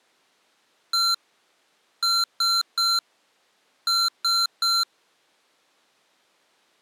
Beep code, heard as beeps from a small speaker, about 1370 Hz. 1-3-3. In Phoenix BIOS tables: chip or data line failure in the first 64 KB of memory.